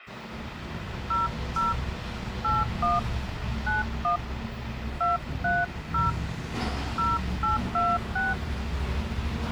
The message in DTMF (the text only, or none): 00 81 91 230 0826